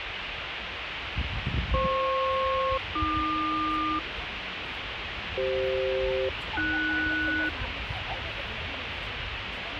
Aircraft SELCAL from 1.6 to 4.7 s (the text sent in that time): FP-AQ